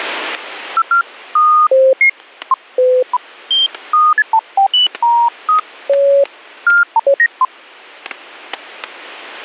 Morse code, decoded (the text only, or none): none